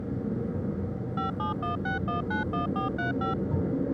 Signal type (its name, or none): DTMF